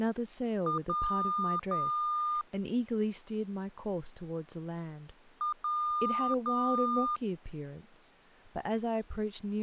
Beep code, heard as beeps, played twice, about 1210 Hz, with speech in English. 1 short, 2 long.